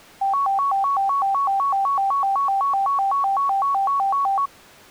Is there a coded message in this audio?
No, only a tone that alternates evenly between two pitches.